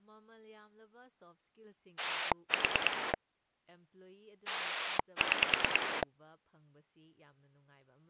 Pulse dialling, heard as a rotary dial, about 9 pulses a second, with speech in Manipuri. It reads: 4 6